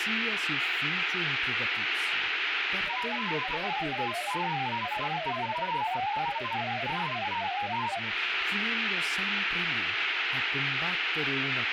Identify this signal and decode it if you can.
Multi-tone FSK (Olivia or MFSK type), about 500 Hz wide, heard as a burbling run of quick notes, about 31.25 baud, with radio static and speech in Italian.